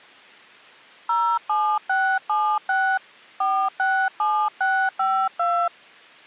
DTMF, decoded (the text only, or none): 07676 467652